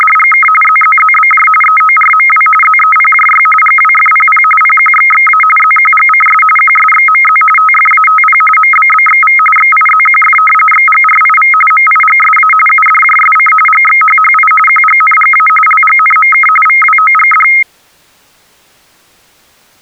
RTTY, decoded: … ZZZBJ EORMW ZEPJY GWFPP PQXXA ZQGCS QSXMZ TFATP MBBXV XIZQF XGRIV MIGSA UDJSC GXHHI QGNGA LGNMK VWOGD

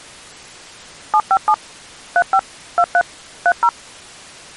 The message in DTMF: 757 35 23 30

